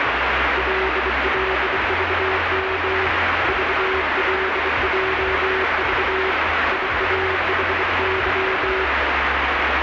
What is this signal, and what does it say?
Morse code, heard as a keyed tone, hand-sent with a bug key, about 24 wpm, 380 Hz, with heavy radio static and the noise inside a car. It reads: LLVM VLJV IAHY